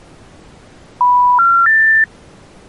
Telephone call progress tone (North American plan), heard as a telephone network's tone, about 980, 1370, 1800 Hz. Special information tone.